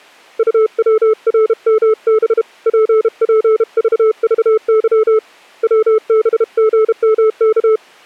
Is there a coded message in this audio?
Yes: Morse code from 0.3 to 7.8 s, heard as a keyed tone, hand-sent with a paddle, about 32 wpm, 440 Hz. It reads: UWRMB PPVVY WBGMK